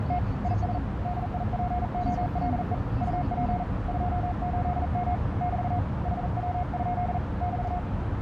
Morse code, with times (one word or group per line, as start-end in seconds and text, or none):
0.0-0.2 …
0.4-0.8 IS
1.0-2.7 DIPOLE
3.0-3.6 UP
3.9-5.1 28M
5.4-5.8 <BT>
6.1-7.2 HW?
7.4-7.8 <BT>